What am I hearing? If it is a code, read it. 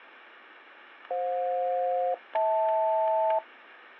Aircraft SELCAL, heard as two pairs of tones, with static crashes. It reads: FJ-HL